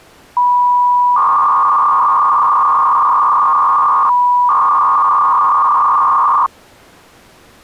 300-baud modem data (V.21 tones), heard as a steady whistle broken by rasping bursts, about 300 baud, 200 Hz shift.